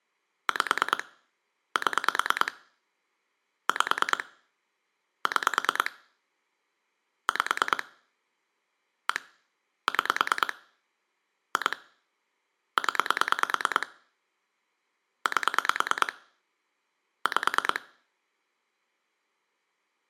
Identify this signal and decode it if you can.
Pulse dialling, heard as clicks on a phone line, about 9 pulses a second. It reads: 5 7 5 6 5 1 6 2 0 8 5